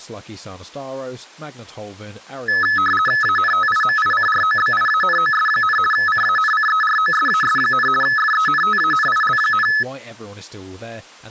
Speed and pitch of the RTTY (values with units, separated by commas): 50 baud, 450 Hz shift, 1500 Hz centre